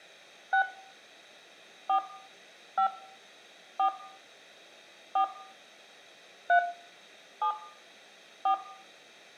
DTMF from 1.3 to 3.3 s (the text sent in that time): 4 5